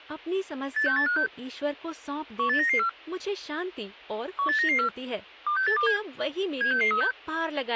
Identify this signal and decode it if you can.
Five-tone selective call (CCIR), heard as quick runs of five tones, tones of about 100 ms, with speech in Hindi. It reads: 86856 18994 18994 26827 76636